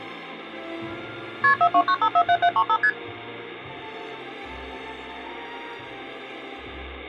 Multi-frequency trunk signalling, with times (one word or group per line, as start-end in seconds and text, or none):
1.4-1.5 KP
1.6-2.8 429547735
2.8-2.9 ST